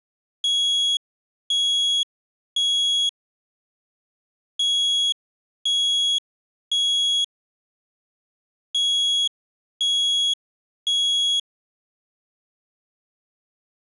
Alarm pattern, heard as an alarm's beeps, played three times, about 3350 Hz. Temporal three. Smoke or fire, evacuate.